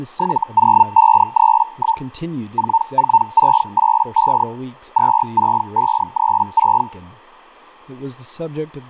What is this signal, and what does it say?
Hellschreiber (Feld-Hell, 122.5 baud), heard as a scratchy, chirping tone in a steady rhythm, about 900 Hz, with fading and speech in English. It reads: 70531 44685 26536